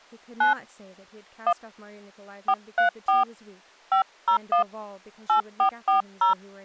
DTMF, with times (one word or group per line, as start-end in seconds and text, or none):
0.4-0.5 9
1.5-1.5 1
2.5-3.2 434
3.9-4.6 501
5.3-6.3 8440